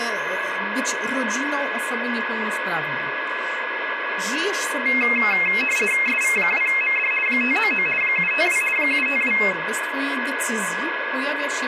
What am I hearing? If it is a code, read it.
RTTY (50 baud, 450 Hz shift), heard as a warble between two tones, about 2350 Hz centre, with radio static, a steady whistle near 1680 Hz and speech in Polish. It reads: SV2MD 599 752 752